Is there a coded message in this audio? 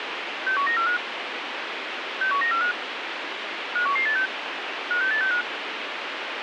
Yes: five-tone selective call (CCIR) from 0.5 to 5.4 s, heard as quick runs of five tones, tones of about 100 ms, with radio hiss. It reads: 61945 61945 51186 56865